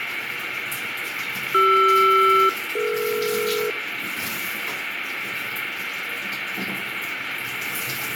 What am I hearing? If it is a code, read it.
Aircraft SELCAL, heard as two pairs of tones, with radio static, room echo and the noise of a restroom. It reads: CR-DE